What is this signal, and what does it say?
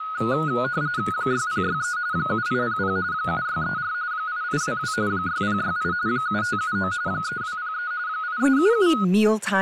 RTTY (45.45 baud, 170 Hz shift), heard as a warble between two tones, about 1360 Hz centre, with speech in English. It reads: 6063 7800 7634 8822 6068 7579 3203 8377